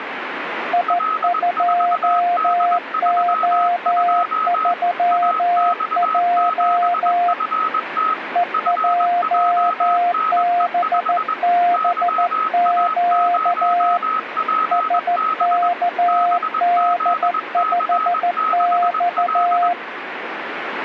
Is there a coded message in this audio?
Yes: Morse code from 0.7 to 19.8 s, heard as two keyed tones, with radio static. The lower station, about 14 wpm, 700 Hz: I2O3J EJBBQ SKD5X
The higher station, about 21 wpm, 1280 Hz: L4D32 AX7FT FJNE5 YA0PB BZC6L